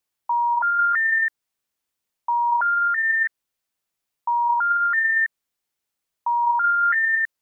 Telephone call progress tone (ITU plan), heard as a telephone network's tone, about 950, 1400, 1800 Hz. Special information tone.